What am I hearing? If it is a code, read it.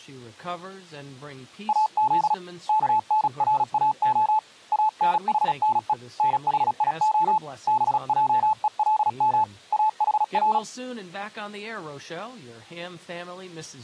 Morse code (Hebrew alphabet), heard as a keyed tone, hand-sent with a paddle, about 36 wpm, 870 Hz, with speech in English. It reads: אז כנראה אנחנו נחיה בעולם אחר